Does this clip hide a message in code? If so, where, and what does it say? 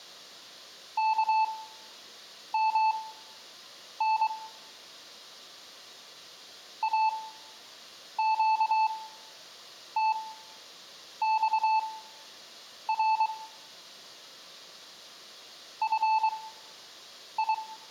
Yes: Morse code (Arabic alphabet) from 0.9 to 17.6 s, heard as a keyed tone, machine-sent, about 23 wpm, spaced as for 7 wpm, 880 Hz, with room echo. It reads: كمن اقتصر في